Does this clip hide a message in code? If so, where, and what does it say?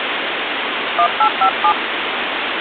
Yes: DTMF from 1.0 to 1.7 s, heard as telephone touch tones, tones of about 80 ms, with phone line noise. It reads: 1857